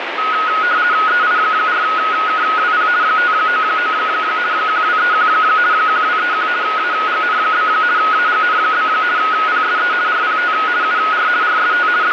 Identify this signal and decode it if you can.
RTTY (50 baud, 170 Hz shift), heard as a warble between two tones, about 1360 Hz centre, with radio static. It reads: EI4KWP 599 1231 1231 AGN? AGN? PSE RPT UR RST …